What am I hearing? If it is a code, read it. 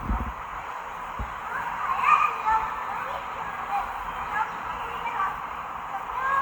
The noise of a park. There is no code.